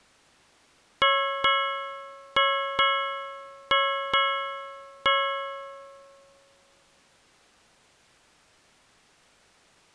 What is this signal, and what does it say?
Ship's bell, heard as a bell. 7. Seven half-hours of the watch have passed.